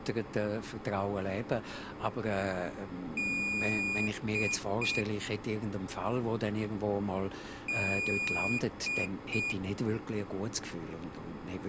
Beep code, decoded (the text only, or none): 1 long, 2 short